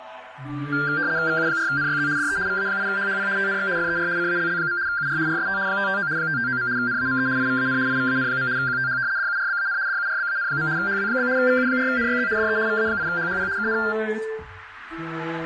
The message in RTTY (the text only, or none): VU4NYZ DE VA8HHP TNX FER CALL. UR RST 559 559. NAME IVAN IVAN. QTH DURBAN DURBAN. HW? VU4NYZ DE VA8HHP KN